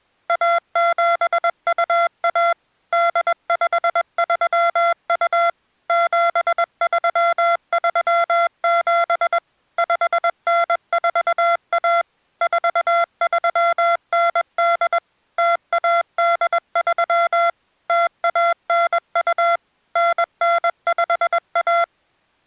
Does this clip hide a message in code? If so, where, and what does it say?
Yes: Morse code (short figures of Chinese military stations) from 0.2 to 21.9 s, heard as electronic beeps, machine-sent, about 21 wpm, 680 Hz. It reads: 1721 8532 7337 5941 4398 0183 0192 9951